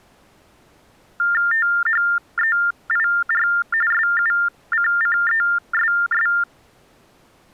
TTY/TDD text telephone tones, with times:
1.5-3.5 THEIR
3.9-6.3 SUCCESS

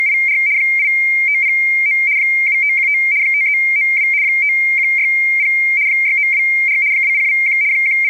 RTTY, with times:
0.0-0.4 …
0.6-2.0 8509
2.2-3.0 7515
3.2-4.1 5392
4.2-5.5 5160
5.9-6.8 6924
6.9-7.6 2021
7.7-8.1 …

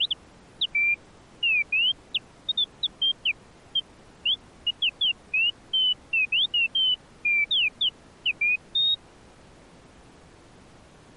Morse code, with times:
none

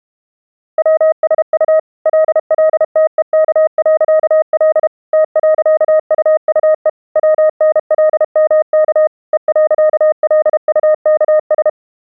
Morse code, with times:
0.8-1.8 WSU
2.1-4.9 LLTEK.L
5.1-6.9 T.UUE
7.2-9.1 WNLMK
9.3-11.7 E.LUKS

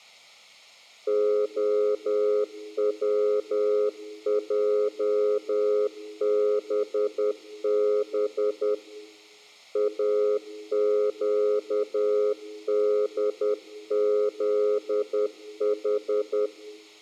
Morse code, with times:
1.1-8.7 OWJBB
9.8-16.5 AQDZH

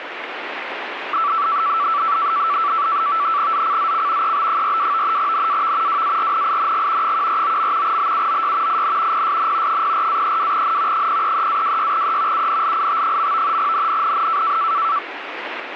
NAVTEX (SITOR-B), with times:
3.5-4.3 ZCZC
4.2-5.2 EB42
5.2-6.0 NAV
5.9-7.1 WARNING
7.0-8.0 149.
7.8-8.8 BUOY
8.7-9.2 IN
9.1-9.8 PSN
9.7-11.1 04-32N
10.9-12.5 033-26E
12.3-13.6 UNLIT.
13.6-14.6 NNNN

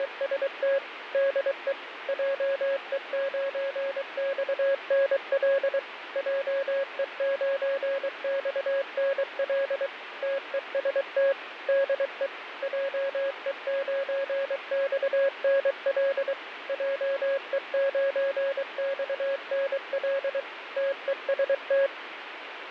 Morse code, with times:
0.0-0.8 …
1.1-1.7 DE
2.1-5.8 JE9XNL
6.2-9.9 JE9XNL
10.2-11.3 TEST
11.7-12.3 DE
12.6-16.3 JE9XNL
16.7-20.4 JE9XNL
20.8-21.9 TEST

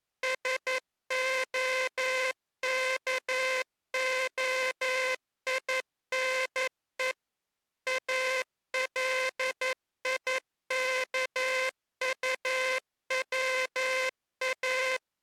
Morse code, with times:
0.2-7.1 SOKOINE
7.9-15.0 ALIKUWA

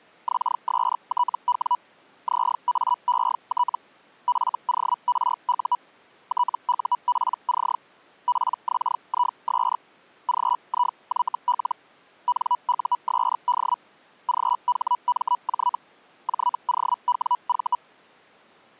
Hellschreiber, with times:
0.3-1.8 XSTW
2.3-3.8 ZAET
4.3-5.8 FORU
6.3-7.8 TUPC
8.3-9.8 PXIS
10.3-11.8 GIYL
12.3-13.8 NUSD
14.3-15.8 GHMJ
16.3-17.8 JOWV

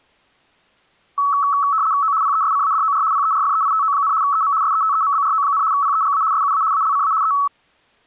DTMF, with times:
none

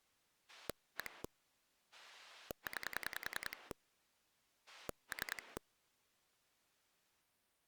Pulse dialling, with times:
0.5-1.2 1
1.9-3.7 9
4.7-5.6 3

